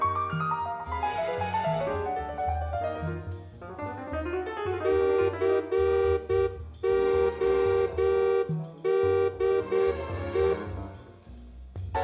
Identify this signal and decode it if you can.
Morse code, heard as a horn, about 8 wpm, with room echo. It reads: CODE